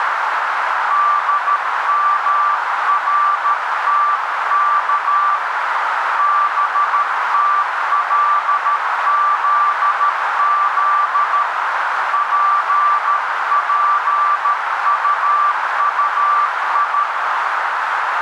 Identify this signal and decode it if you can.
Morse code (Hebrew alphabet), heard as a keyed tone, hand-sent with a paddle, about 13 wpm, 1170 Hz, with heavy radio static and a narrow filter. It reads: דמרתך בתלזז פפטטי